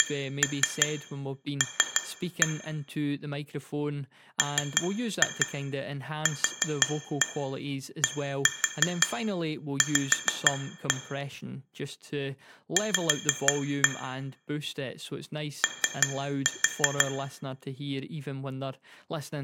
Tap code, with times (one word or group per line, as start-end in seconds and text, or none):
0.0-2.5 CL
4.4-10.9 MQDV
12.8-13.9 V
15.6-17.1 O